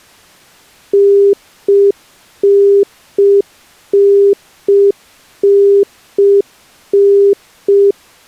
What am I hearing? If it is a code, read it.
Telephone call progress tone (UK plan), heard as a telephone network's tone, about 400 Hz. Congestion tone.